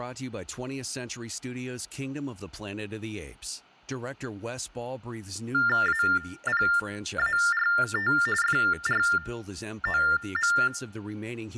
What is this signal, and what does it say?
TTY/TDD text telephone tones (45.45 baud Baudot), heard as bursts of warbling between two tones, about 400 Hz shift, 1600 Hz centre, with speech in English. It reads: APART FROM